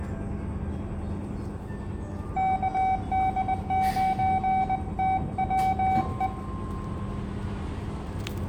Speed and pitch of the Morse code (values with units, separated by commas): 20 wpm, 760 Hz